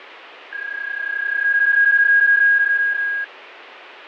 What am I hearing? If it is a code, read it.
PSK31 (31.25 baud), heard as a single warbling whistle, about 1650 Hz, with radio static and fading.